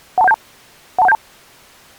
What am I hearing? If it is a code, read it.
Five-tone selective call (EIA), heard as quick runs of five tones, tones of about 30 ms. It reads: 12172 12172